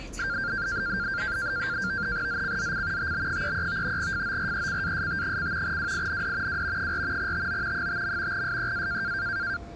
NAVTEX (SITOR-B), 100 baud, 170 Hz shift, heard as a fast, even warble, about 1490 Hz centre, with the noise inside a subway train. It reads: ZCZC TB33 FORECAST: WIND W 4 TO 5. SEA